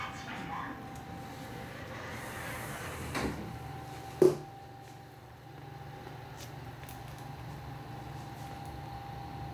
The noise inside a lift. There is no code.